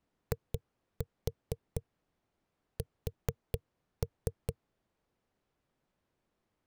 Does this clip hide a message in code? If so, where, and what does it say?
Yes: tap code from 0.3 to 4.6 s, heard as knocks on a wall, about 4 knocks a second. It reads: IS